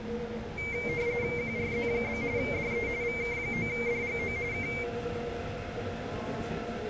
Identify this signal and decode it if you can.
RTTY (45.45 baud, 170 Hz shift), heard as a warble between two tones, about 2200 Hz centre, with the noise inside a subway train. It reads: QRZ? DE VK9DGO K